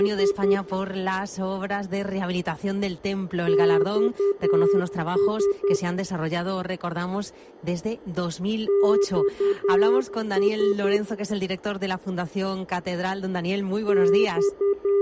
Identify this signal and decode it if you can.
Morse code, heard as a keyed tone, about 10 wpm, 400 Hz, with room echo. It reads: … XS XS …